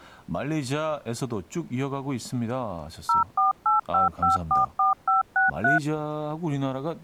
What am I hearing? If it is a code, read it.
DTMF, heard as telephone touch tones, dialled by machine, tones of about 140 ms, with speech in Korean. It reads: 0485544563